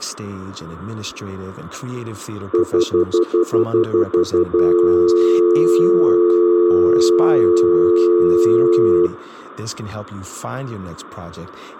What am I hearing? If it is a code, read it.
Telephone call progress tone (North American plan), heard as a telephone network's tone, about 350, 440 Hz, 0.1 s on and 0.1 s off, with speech in English. Stutter dial tone.